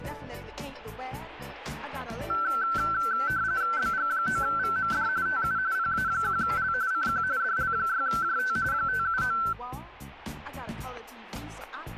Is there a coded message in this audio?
Yes: RTTY (45.45 baud, 170 Hz shift) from 2.3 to 9.5 s, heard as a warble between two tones, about 1440 Hz centre, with static crashes. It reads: BG9VMD TU PA1L CQ DL6JT 579